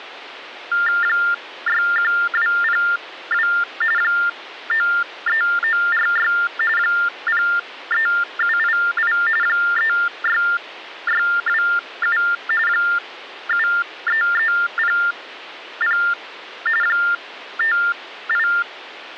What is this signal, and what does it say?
TTY/TDD text telephone tones (45.45 baud Baudot), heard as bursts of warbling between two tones, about 400 Hz shift, 1600 Hz centre. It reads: 61202 93946 03788 36627 73300 …